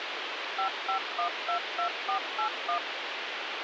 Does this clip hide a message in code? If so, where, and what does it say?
Yes: DTMF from 0.6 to 2.8 s, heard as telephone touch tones, dialled by machine, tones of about 100 ms, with radio hiss. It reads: 55122481